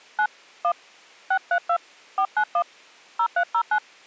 DTMF, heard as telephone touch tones, dialled by hand, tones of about 70 ms. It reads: 9 1 632 491 0309